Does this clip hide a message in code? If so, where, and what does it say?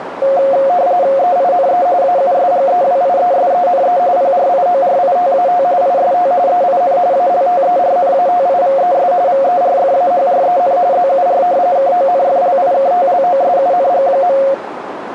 Yes: RTTY (45.45 baud, 170 Hz shift) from 0.2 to 14.5 s, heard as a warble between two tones, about 630 Hz centre, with radio static and a narrow filter. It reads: EINE AUSGEWIESENE PRIORITAT IST EIN ALTERNATIVES VERFAHREN ZUR KONFLIKTLOSUNG.